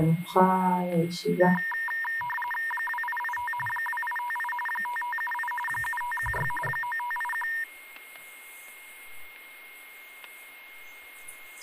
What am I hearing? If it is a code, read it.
RTTY (45.45 baud, 850 Hz shift), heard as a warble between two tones, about 1400 Hz centre, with static crashes and a steady whistle near 2140 Hz. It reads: 2885 2858 5578 7516 9581